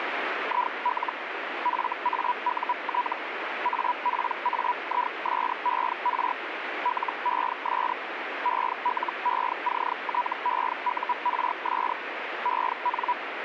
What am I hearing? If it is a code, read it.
Hellschreiber (Feld-Hell, 122.5 baud), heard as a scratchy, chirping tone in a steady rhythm, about 980 Hz, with radio static. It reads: IL FAUT APAISER LES ELECTEURS EN